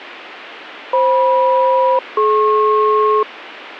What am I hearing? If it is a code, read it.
Aircraft SELCAL, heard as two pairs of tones, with radio hiss. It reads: FM-DP